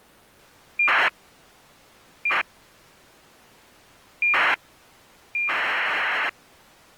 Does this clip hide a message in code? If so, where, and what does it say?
Yes: ACARS aircraft data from 0.8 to 6.3 s, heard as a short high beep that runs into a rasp, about 2400 baud.